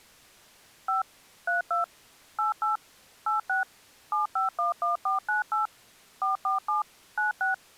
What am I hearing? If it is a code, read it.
DTMF, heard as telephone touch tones, dialled by machine, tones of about 140 ms. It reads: 5 32 88 86 7511498 447 96